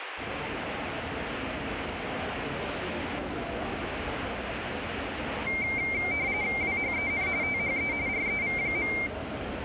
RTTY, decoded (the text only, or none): WHEN THE REV.